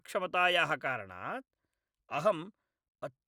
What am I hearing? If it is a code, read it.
Speech in Sanskrit. There is no code.